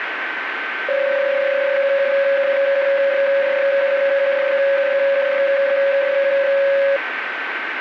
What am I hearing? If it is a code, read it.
PSK31 (31.25 baud), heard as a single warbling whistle, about 550 Hz, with radio static and a steady whistle near 1540 Hz.